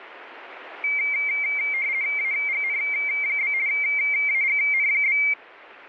RTTY (50 baud, 170 Hz shift), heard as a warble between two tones, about 2200 Hz centre. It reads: AGN? AGN?